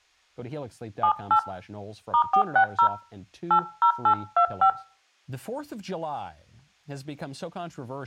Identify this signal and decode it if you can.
DTMF, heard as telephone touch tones, dialled by hand, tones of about 90 ms, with speech in English. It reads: 78 *460 80825